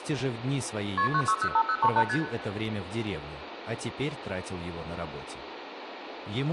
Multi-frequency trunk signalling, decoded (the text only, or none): KP 9605038 ST